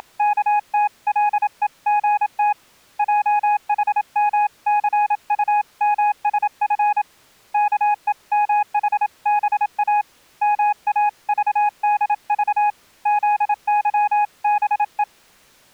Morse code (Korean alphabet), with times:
0.0-2.5 …
3.0-7.0 훔치면
7.5-10.0 아무도
10.4-12.7 모를
13.1-15.0 테다

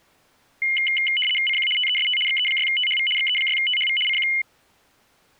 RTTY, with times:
1.5-1.7 CQ
1.8-2.2 TEST
2.3-3.1 XE6THV
3.2-4.0 XE6THV
4.1-4.3 CQ

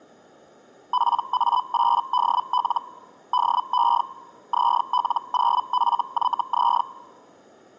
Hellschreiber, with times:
0.9-2.8 PA8DL
3.3-4.0 DE
4.5-6.8 ZL0FYZ

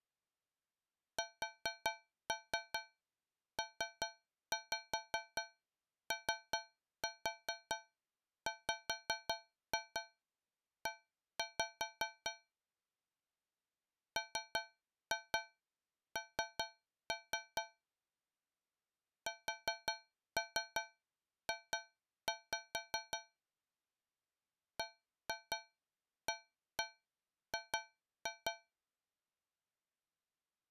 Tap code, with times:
1.2-12.3 SPOWE
14.2-17.6 MN
19.3-23.2 SJ
24.8-28.5 BAG

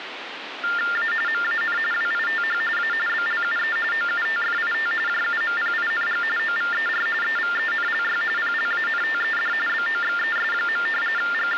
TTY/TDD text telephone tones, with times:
1.0-1.1 A
1.3-1.8 MAN
1.9-2.6 WITH
2.8-2.9 A
3.1-3.8 BLUE
3.9-4.9 OUTFIT
5.1-6.2 JUMPING
6.4-7.1 OVER
7.2-8.2 EVENLY
8.4-9.5 PLANTED
9.7-10.9 BOXES.
11.2-11.6 …

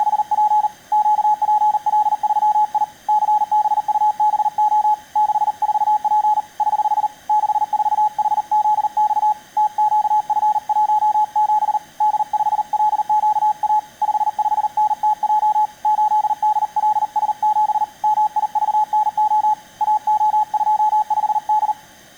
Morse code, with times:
0.0-0.7 …
0.9-2.8 QPL3I
3.1-4.9 CBUBO
5.2-6.4 64P
6.6-7.1 <HH>
7.3-9.3 64HZX
9.6-11.8 TQF17
12.0-13.8 D5LQA
14.0-15.6 55NTJ
15.8-17.8 8DLS7
18.0-19.5 MIVNO
19.8-21.7 AO25D

